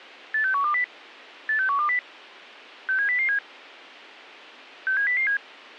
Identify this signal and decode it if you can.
Five-tone selective call (CCIR), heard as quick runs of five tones, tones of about 100 ms. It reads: 86120 86120 67007 67007